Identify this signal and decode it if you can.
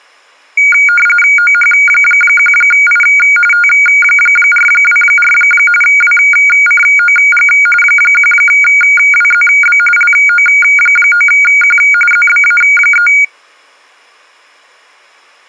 RTTY (45.45 baud, 850 Hz shift), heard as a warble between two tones, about 1850 Hz centre. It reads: OH1I T424 WCOG 1WZB LO9Q ZBA3